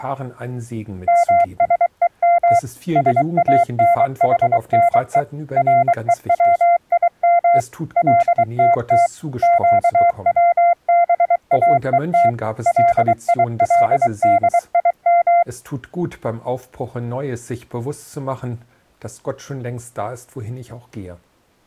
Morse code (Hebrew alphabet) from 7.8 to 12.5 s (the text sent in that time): לתת קצבאות